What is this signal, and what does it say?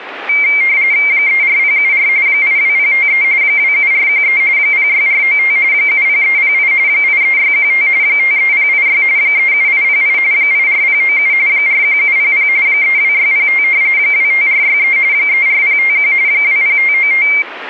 RTTY (45.45 baud, 170 Hz shift), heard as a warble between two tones, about 2200 Hz centre. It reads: 34074 82053 27413 06495 70308 83615 53086 37808 84097 41700 32605 25463 34051 20595